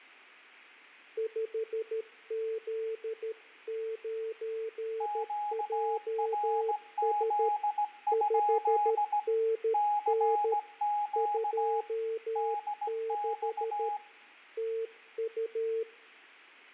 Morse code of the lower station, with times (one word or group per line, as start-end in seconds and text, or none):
1.2-7.5 5Z9JS
8.1-10.5 5NN
11.2-13.9 26
14.6-15.8 TU